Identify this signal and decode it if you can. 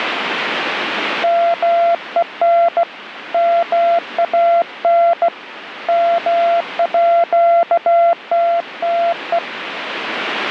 Morse code (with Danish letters), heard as a keyed tone, hand-sent with a bug key, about 16 wpm, 680 Hz, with radio static. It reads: MEN MAN MÅTTE